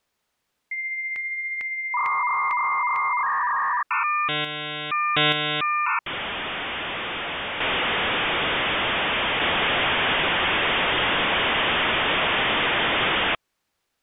Dial-up modem handshake (V.34 or later), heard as a whistle, warbles, then hiss.